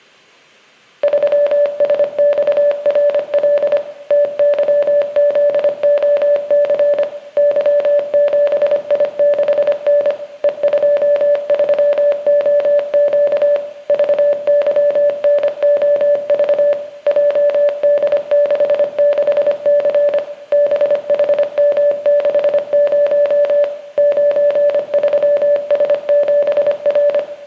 Morse code, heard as a keyed tone, machine-sent, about 25 wpm, 580 Hz, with room echo. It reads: 3SXRL TYZOC Y7I6N E23OQ VYNOV JD66C BHM60 93S7R